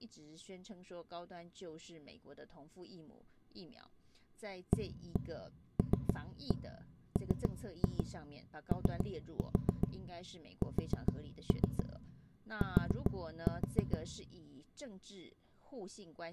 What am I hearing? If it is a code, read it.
Tap code, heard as knocks on wood, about 7 knocks a second, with room echo and speech in Chinese. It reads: ALMOST